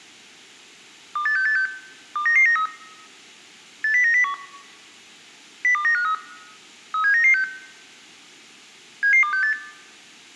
Five-tone selective call (CCIR), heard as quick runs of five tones, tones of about 100 ms. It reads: 28686 29993 80901 02953 37996 77268